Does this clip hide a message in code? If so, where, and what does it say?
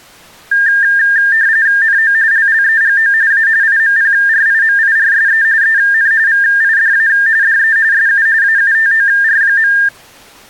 Yes: RTTY (45.45 baud, 170 Hz shift) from 0.5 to 9.9 s, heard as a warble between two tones, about 1700 Hz centre. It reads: NO LLEGO A IMPRIMIRSE EN VIDA DE SU AUTOR.